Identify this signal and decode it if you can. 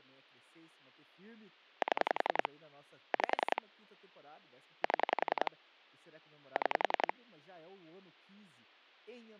Pulse dialling, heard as clicks on a phone line, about 10 pulses a second, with speech in Portuguese. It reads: 7 5 7 6